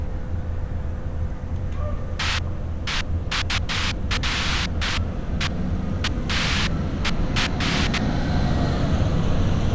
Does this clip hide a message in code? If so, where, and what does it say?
No, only bursts of noise, with street noise.